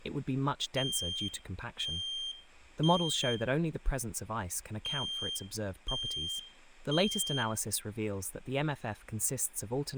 Alarm pattern, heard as an alarm's beeps, played twice, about 3200 Hz, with room echo and speech in English. Temporal three. Smoke or fire, evacuate.